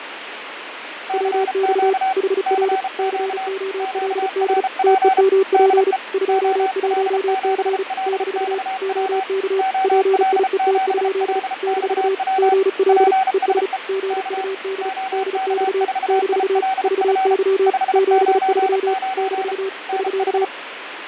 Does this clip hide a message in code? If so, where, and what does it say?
Yes: Morse code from 1.0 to 20.5 s, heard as two keyed tones, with radio static and fading. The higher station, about 33 wpm, 760 Hz: CQ CQ QRP DE OL7LXW OL7LXW PSE K OK4ILF 599 NH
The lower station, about 35 wpm, 390 Hz: WX HR COLD TEMP 21C - OK PIET? - GL ES GUD DX - VY 73 - <SK>